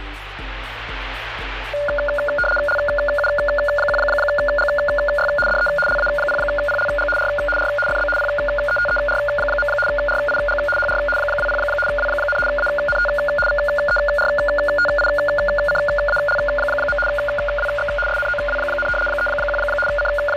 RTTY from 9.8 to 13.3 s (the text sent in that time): RIG HR 20 W, ANT